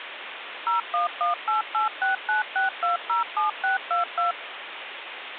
DTMF, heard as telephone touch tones, dialled by machine, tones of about 140 ms, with phone line noise. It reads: 01188696207622